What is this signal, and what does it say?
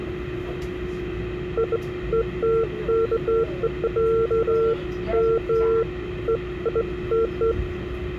Beeps of irregular length, with the noise inside a subway train. There is no code.